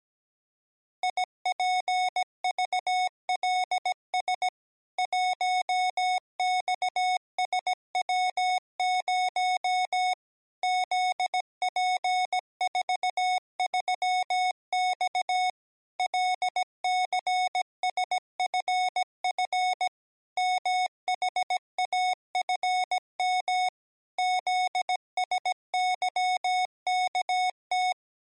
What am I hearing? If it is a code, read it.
Morse code, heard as electronic beeps, machine-sent, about 17 wpm, 740 Hz. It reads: IPVLS 1XSW0 ZP43X LCSFF MHAFM ZSYKT